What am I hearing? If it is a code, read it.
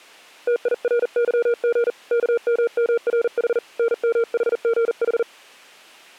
Morse code, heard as a keyed tone, hand-sent with a paddle, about 40 wpm, 460 Hz. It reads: TIRYG KMMRH NMHGH